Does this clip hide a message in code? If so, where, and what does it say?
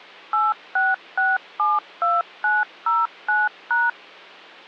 Yes: DTMF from 0.3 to 3.9 s, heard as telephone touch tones, dialled by machine, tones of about 190 ms. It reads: 86672909#